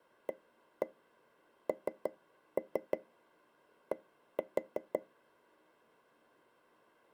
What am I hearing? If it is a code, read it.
Tap code, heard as taps on a table, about 6 knocks a second. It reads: AND